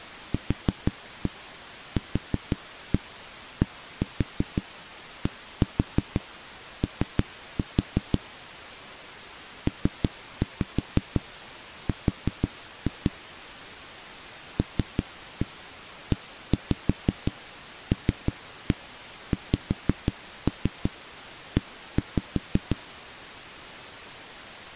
Tap code, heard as knocks on a wall, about 6 knocks a second. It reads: QQDDO PR LELXE